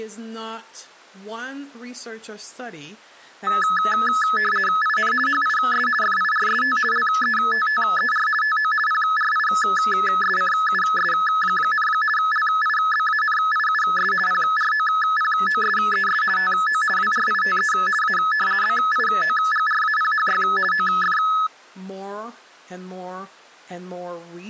RTTY (50 baud, 450 Hz shift), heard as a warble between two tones, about 1500 Hz centre, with speech in English. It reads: IN HIS FIRST LETTER TO PRISCUS, LIBANIUS PROPOSES TO WRITE A BIOGRAPHY OF